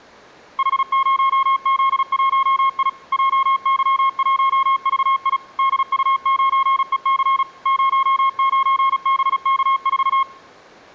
Morse code, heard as a keyed tone, machine-sent, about 36 wpm, 1080 Hz. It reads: H0Z1I JY1VI DU9EC 09BK4